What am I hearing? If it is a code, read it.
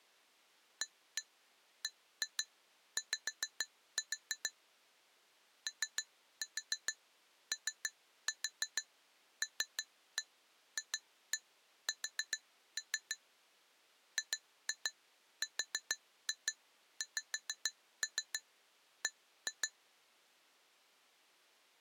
Tap code, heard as taps on glass, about 6 knocks a second. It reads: ABY OOLFS GRXB